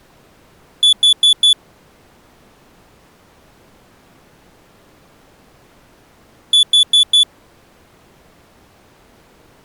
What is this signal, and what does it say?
Alarm pattern, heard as an alarm's beeps, played twice, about 3450 Hz. Temporal four. Carbon monoxide.